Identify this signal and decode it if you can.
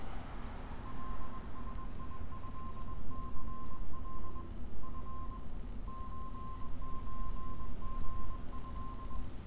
Morse code (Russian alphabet), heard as a keyed tone, hand-sent with a bug key, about 21 wpm, 1050 Hz, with room echo and street noise. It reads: ЛСИЭЦЛ Ф ЧЧГЭ